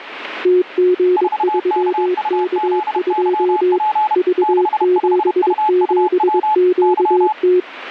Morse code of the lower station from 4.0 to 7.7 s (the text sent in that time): V77QT